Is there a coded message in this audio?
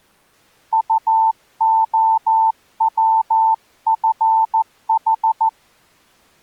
Yes: Morse code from 0.7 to 5.5 s, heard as a keyed tone, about 14 wpm, 890 Hz. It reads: UOWFH